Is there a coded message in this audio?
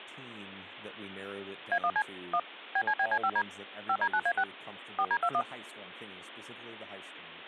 Yes: DTMF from 1.7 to 5.4 s, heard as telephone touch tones, dialled by machine, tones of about 60 ms, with speech in English. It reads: A1C 1 BCBC5D 5D9A6 4D21